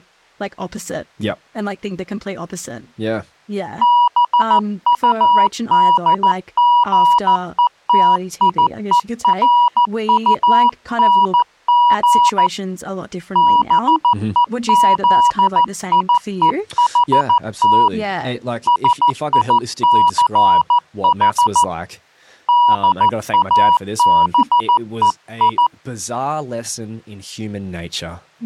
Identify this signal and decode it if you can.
Morse code, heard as a keyed tone, hand-sent with a paddle, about 14 wpm, 970 Hz, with speech in English. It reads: BUDGETIERUNG BEZIEHT SICH DABEI